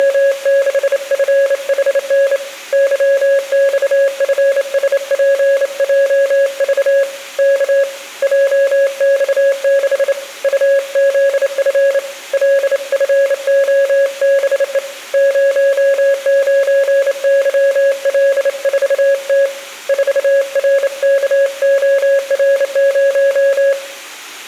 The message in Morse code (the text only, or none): … YXFSPJV K JX6 UZF LFOBE 09YL4T 4RKOR0